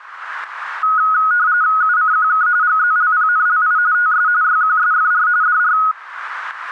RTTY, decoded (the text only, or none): UCQK GZLPNLI TS YQSFR DR